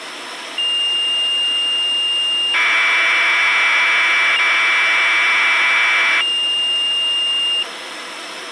Commodore tape loading (standard loader), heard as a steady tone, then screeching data, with tape hiss.